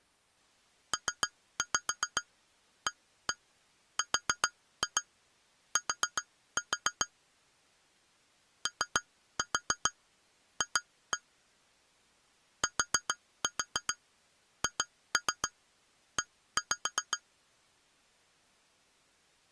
Tap code, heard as taps on glass, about 7 knocks a second. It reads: PART OF THE